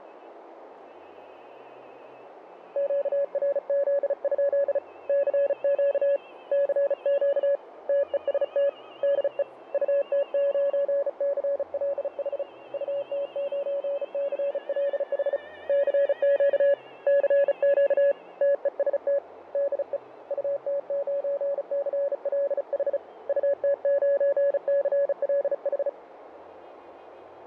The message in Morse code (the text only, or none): QRZ? CQ CQ TEST DE UT9CLH UT9CLH CQ CQ TEST DE UT9CLH UT9CLH